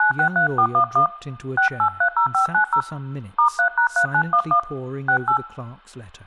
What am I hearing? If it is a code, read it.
DTMF, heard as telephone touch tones, dialled by hand, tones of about 90 ms, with speech in English. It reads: 963411 6830590 *3#3911 68